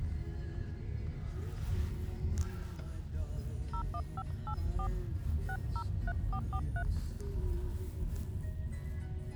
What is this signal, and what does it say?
DTMF, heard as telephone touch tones, dialled by hand, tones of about 80 ms, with the noise inside a car. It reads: 01584 603443